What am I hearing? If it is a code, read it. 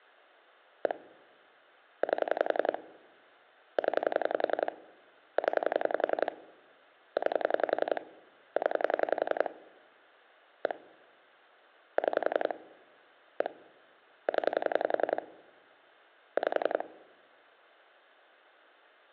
Pulse dialling, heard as clicks on a phone line, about 11 pulses a second. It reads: 1 8 0 0 9 0 1 6 1 0 5